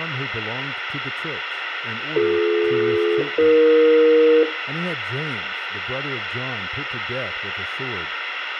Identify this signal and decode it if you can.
Aircraft SELCAL, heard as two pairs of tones, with room echo and speech in English. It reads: BD-AE